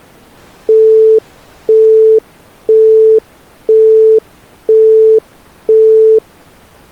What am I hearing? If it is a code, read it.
Telephone call progress tone (single-tone plan, as in Europe, Japan and elsewhere), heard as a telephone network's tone, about 440 Hz, 0.5 s on and 0.5 s off. Busy tone.